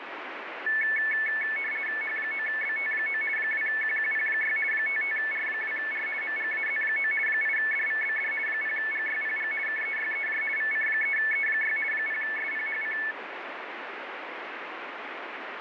RTTY (50 baud, 450 Hz shift), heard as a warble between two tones, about 2000 Hz centre, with radio static. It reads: H9BT9 2QQP6 55R2R MGAZ9 8DVBD 0GYPG KEYEJ VC3E6 0SPHC